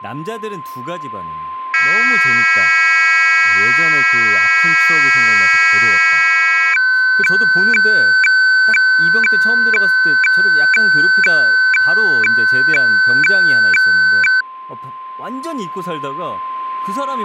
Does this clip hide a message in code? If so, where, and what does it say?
Yes: weather fax (radiofax), 120 lines a minute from 1.7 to 14.4 s, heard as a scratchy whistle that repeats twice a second, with a steady whistle near 1040 Hz and speech in Korean.